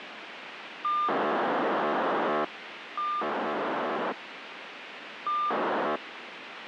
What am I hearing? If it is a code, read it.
POCSAG pager data (2400 baud), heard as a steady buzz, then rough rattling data, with radio hiss.